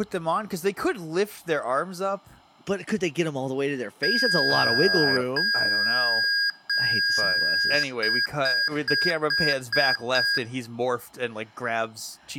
Beep code, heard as beeps from a small speaker, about 1650 Hz, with speech in English. 3 long, 6 short.